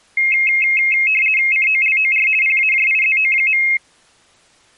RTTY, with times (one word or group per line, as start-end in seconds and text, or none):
1.5-2.3 COLOR
2.4-3.6 PAJIZO.